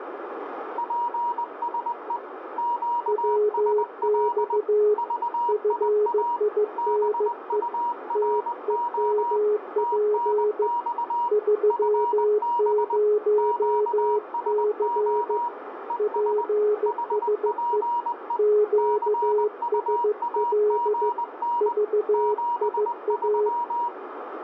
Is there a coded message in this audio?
Yes: Morse code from 0.7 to 23.9 s, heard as two keyed tones, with radio static and room echo. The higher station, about 20 wpm, 950 Hz: PSE QSL VIA BURO TNX FB QSO ES HPE CUAGN 73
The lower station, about 15 wpm, 420 Hz: WX FINE TEMP 30C PSE QSL VIA